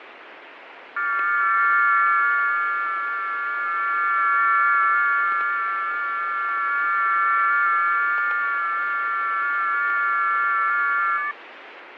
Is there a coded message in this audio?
Yes: FT8 (several signals at once) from 1.0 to 11.3 s, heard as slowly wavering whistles, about 6.25 baud, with radio static and fading.